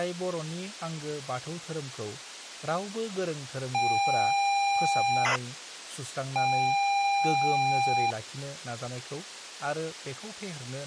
ZX Spectrum tape loading, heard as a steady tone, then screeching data, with speech in Bodo.